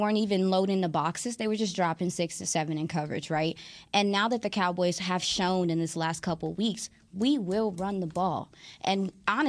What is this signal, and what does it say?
Speech in English. There is no code.